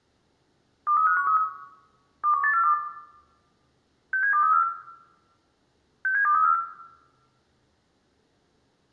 Five-tone selective call (CCIR), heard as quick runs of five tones, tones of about 100 ms, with room echo. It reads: 23513 21842 67234 67234